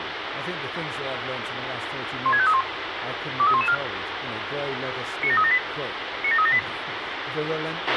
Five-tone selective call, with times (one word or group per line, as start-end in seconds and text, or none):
2.3-2.6 16531
3.4-3.7 23114
5.2-5.6 97378
6.2-6.6 97378